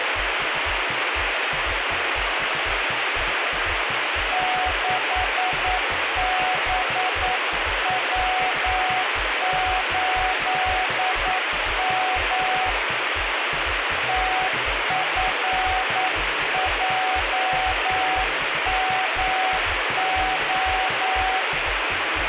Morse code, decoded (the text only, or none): 6BW8M TFJMO